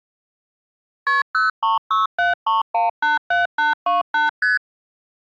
Multi-frequency trunk signalling (R1, as on North American trunks), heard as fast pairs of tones, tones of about 150 ms. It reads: KP 03673187828 ST